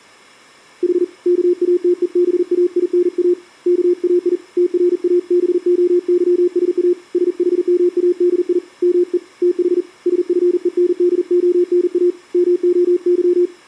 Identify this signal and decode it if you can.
Morse code (Greek alphabet), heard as a keyed tone, hand-sent with a paddle, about 40 wpm, 350 Hz. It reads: Η ΚΑΤΕΒΑΙΝΑ ΚΑΙ ΤΡΑΒΟΥΣΑ ΣΗΜΑΔΙ ΜΕ ΤΗ ΣΦΕΝΔΟΝΑ ΜΟΥ